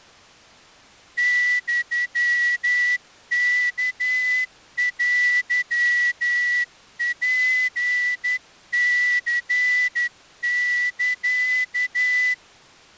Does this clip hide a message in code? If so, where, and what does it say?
Yes: Morse code (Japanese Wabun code) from 1.1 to 12.4 s, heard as a whistle, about 11 wpm. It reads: ユワテツニサ